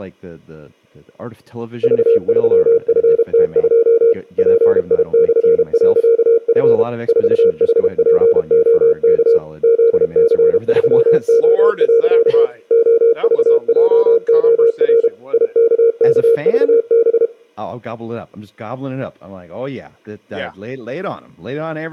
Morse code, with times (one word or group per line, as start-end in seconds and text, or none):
1.8-4.1 V3FT2
4.4-6.8 PI/.F
7.1-9.4 4HPOK
9.6-12.5 ZC3O.
12.7-15.1 OVJOR
15.3-17.3 IKKVB